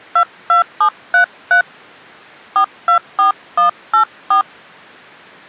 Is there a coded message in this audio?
Yes: DTMF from 0.2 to 4.4 s, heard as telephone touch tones, dialled by hand, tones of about 110 ms. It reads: 22733 424184